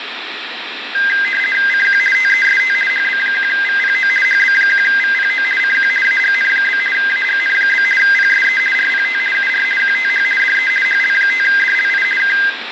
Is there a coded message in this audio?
Yes: RTTY (50 baud, 450 Hz shift) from 0.9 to 12.5 s, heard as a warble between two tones, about 1850 Hz centre, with radio static and room echo. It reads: CQ TEST HB1VPO HB1VPO CQ AGN? AGN? PSE RPT UR QTH DE HL5DLI K